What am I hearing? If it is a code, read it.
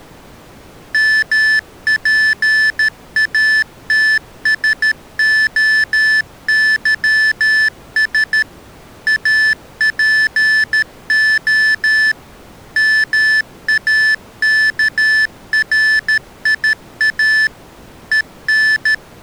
Morse code (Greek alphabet), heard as electronic beeps, machine-sent, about 13 wpm, 1750 Hz. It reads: ΜΠΑΤΣΟΥΣ ΑΠΟ ΜΑΚΡΙΑ …